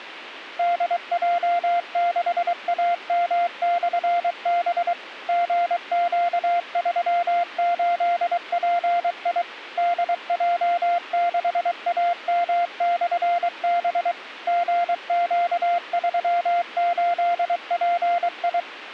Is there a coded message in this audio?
Yes: Morse code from 0.5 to 18.7 s, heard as a keyed tone, machine-sent, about 23 wpm, 700 Hz. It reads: DJ6AM/B GQ38PI DJ6AM/B GQ38PI